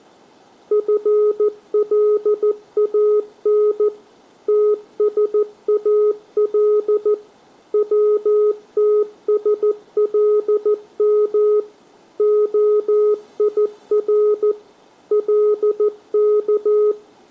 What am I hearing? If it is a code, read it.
Morse code (Arabic alphabet), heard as a keyed tone, machine-sent, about 14 wpm, 420 Hz. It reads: فلان تسال وتسلم خير لك